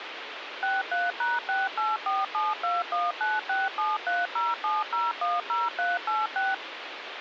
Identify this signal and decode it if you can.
DTMF, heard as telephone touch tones, dialled by machine, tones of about 190 ms, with phone line noise. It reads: 63#684721967307010386